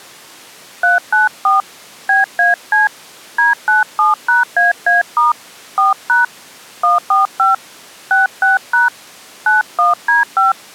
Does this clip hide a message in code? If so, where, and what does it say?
Yes: DTMF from 0.8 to 10.5 s, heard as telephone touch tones, dialled by hand, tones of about 150 ms. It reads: 394 BAC D97#AA* 4# 145 66# 91D5